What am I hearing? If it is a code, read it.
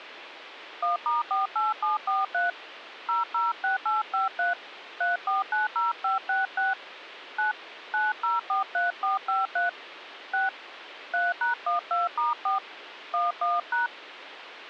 DTMF, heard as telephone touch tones, dialled by hand, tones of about 160 ms, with phone line noise. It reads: 1*48743 006853 3490566 9 9043453 6 3#12*4 11#